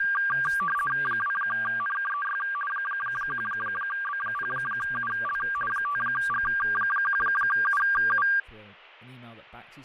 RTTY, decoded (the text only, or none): 2NKEY 1B0UL 5G1UU